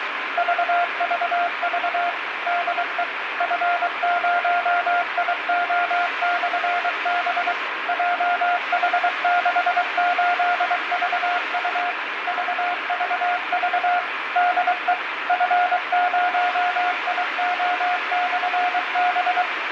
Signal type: Morse code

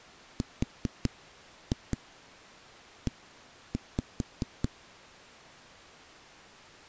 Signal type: tap code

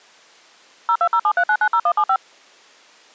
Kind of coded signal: DTMF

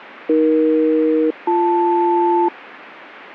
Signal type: aircraft SELCAL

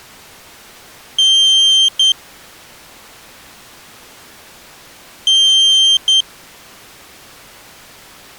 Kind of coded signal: beep code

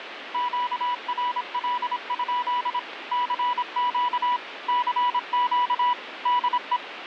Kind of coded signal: Morse code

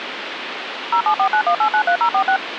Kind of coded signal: DTMF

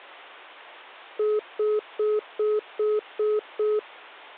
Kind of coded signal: telephone call progress tone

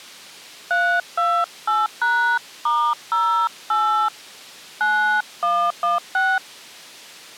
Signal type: DTMF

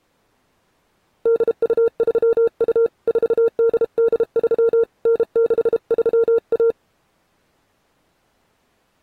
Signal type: Morse code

